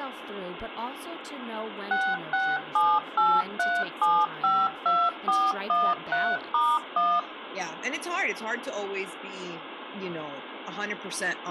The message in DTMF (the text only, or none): 66783752413*1